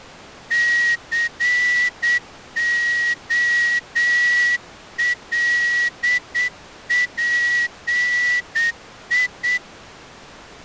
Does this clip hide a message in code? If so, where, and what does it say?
Yes: Morse code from 0.5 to 9.6 s, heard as a whistle, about 8 wpm. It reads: COLPI